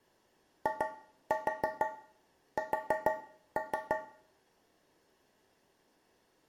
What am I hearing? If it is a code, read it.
Tap code, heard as taps on a metal pipe, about 6 knocks a second, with room echo. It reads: IS